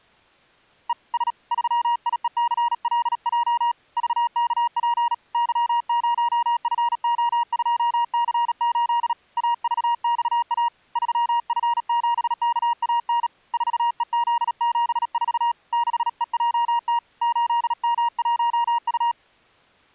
Morse code, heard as a keyed tone, hand-sent with a paddle, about 37 wpm, 950 Hz. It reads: E S 3IECLJ VKP Y0FO2C8 AVXA 3F7KAN 4EZ74 6EJT 8M1U